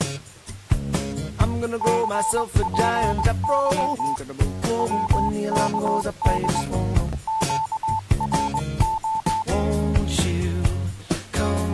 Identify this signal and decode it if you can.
Morse code, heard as a keyed tone, hand-sent with a paddle, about 21 wpm, 880 Hz. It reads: CPY WKD QRO